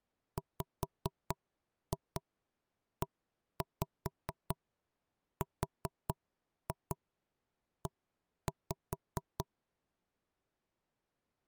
Tap code, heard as knocks on wood, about 4 knocks a second. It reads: WERE